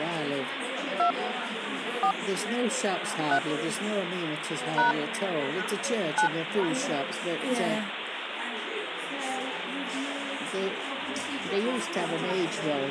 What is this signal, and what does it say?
DTMF, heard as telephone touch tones, dialled by hand, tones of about 100 ms, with phone line noise. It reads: 2 4 3 # 9